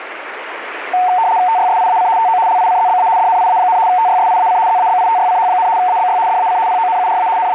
RTTY (75 baud, 170 Hz shift), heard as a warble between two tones, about 820 Hz centre, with radio static. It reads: TYSIAC TO LICZBA DNIA, TYSIAC ZABITYCH, ABY DAC PONURA …